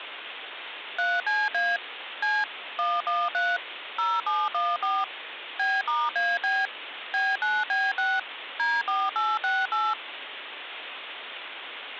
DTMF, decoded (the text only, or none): 3CA C 113 0714 B*AB B9B6 D4868